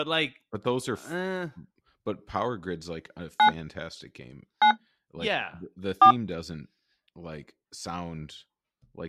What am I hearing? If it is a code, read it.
DTMF, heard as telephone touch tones, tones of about 90 ms, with speech in English. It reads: 9 9 4